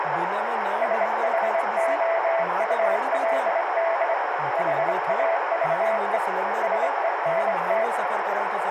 Morse code, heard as a keyed tone, hand-sent with a straight key, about 25 wpm, 660 Hz, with radio static, a narrow filter and speech in Sindhi. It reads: SHOULD HAVE SENT